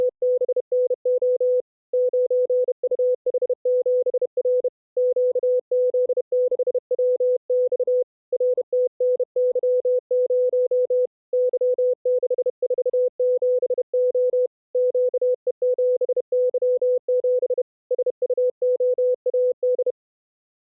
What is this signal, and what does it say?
Morse code, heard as a keyed tone, hand-sent with a bug key, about 31 wpm, 500 Hz. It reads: … 9UH7R QZ6WX RTNY0 Y647O QE7Y7 SUOAD